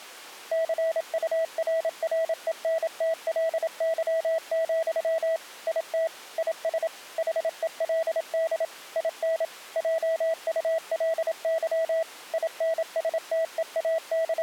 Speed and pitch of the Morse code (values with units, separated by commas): 27 wpm, 650 Hz